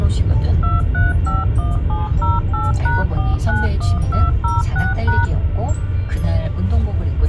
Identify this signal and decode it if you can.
DTMF, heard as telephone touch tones, dialled by machine, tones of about 180 ms, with the noise inside a car. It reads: 2351708#491206#